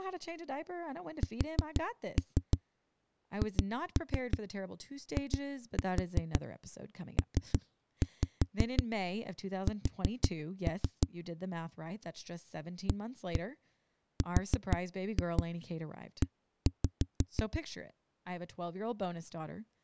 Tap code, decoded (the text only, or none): SHIPS ARE